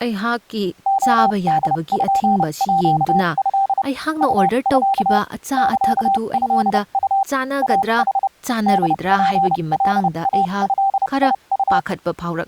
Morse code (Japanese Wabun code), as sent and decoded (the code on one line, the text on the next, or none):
--- -.. ..--. .--.- ..-.. / ..- ..-.- / -.-.- ..-.. ..- / .- .... / -.. .--. .-.. .- ..-.. .. ..-
レポート ウミ サトウ イヌ ホツカイドウ